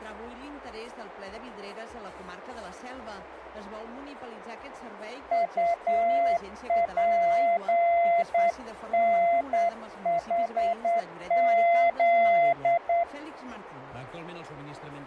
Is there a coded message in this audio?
Yes: Morse code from 5.3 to 13.1 s, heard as a keyed tone, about 9 wpm, 680 Hz, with radio static. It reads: UPNHZ